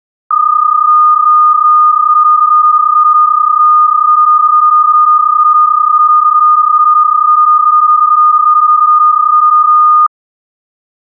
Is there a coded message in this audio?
Yes: PSK31 (31.25 baud) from 0.3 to 10.1 s, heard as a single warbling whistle, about 1220 Hz.